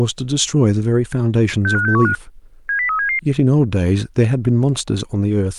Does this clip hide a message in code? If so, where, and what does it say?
Yes: five-tone selective call (CCIR) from 1.7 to 3.2 s, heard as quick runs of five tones, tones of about 100 ms, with speech in English. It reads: 65615 70377